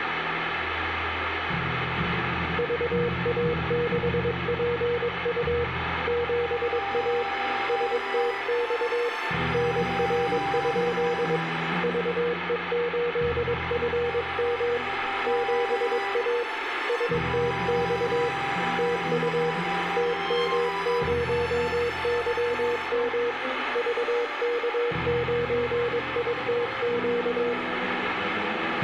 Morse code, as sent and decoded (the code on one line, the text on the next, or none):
...- .- -.... .--. ..- / --... .- / ... - -..- / -. .-. ..--.. / ...- . ---.. ..-. -- / --... .- / ... - -..- / - ..- / - -- ----- -.-- -- / ...- -.- ----. .. - --.-
VA6PU 7A STX NR? VE8FM 7A STX TU TM0YM VK9ITQ